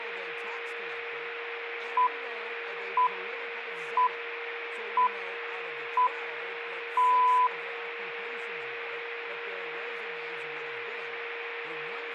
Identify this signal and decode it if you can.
Radio time signal (six pips, as the Greenwich Time Signal), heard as pips, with a steady whistle near 470 Hz.